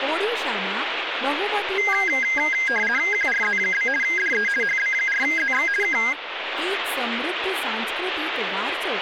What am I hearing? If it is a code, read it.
RTTY (50 baud, 450 Hz shift), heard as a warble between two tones, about 1850 Hz centre, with radio static and speech in Gujarati. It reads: QRZ? DE HB4ZX K